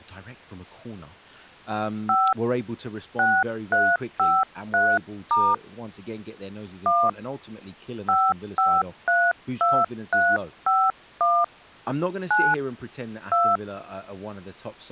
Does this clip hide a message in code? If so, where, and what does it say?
Yes: DTMF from 2.1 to 13.6 s, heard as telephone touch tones, dialled by hand, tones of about 240 ms, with speech in English. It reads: 5 6353* 1 5532351 9 2